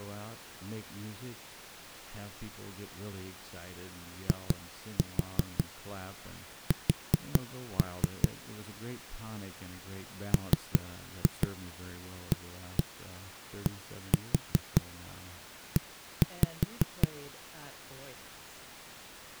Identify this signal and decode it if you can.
Tap code, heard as knocks on a wall, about 5 knocks a second, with speech in English. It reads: IS MADE